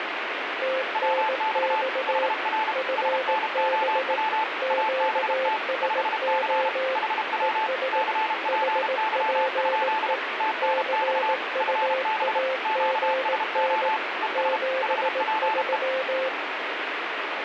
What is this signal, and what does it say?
Morse code, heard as two keyed tones, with radio static. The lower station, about 18 wpm, 520 Hz: TNX FB QSO ES HPE CUAGN 73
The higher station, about 32 wpm, 880 Hz: WX HR SNOW ABT 5C HW CPY? TNX FB QSO ES HPE